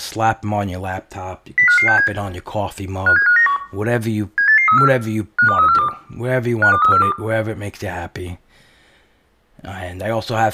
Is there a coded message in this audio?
Yes: five-tone selective call (CCIR) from 1.6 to 7.1 s, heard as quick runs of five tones, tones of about 100 ms, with room echo and speech in English. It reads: 05567 57591 78834 52342 52342